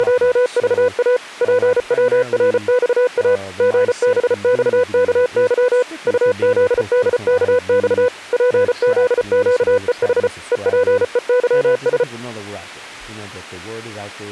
Morse code, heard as a keyed tone, machine-sent, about 34 wpm, 500 Hz, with speech in English. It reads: … PWRXA GBXKY UZDKX PZQEH EPEYS